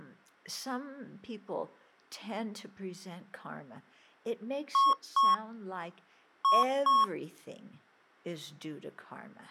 Beep code, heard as beeps from a small speaker, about 1100 Hz, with speech in English. 2-2.